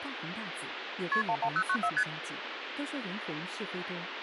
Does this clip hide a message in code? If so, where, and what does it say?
Yes: multi-frequency trunk signalling (R1, as on North American trunks) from 1.1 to 2.0 s, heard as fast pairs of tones, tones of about 70 ms, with phone line noise and speech in Chinese. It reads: KP 11094 ST